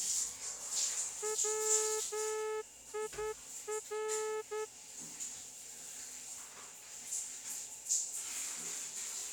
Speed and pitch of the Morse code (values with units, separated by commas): 10 wpm